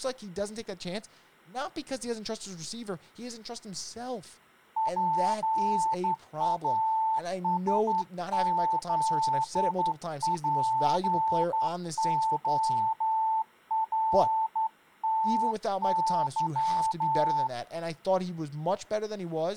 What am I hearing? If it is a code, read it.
Morse code, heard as a keyed tone, hand-sent with a straight key, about 11 wpm, 880 Hz, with speech in English. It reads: PASZPORTY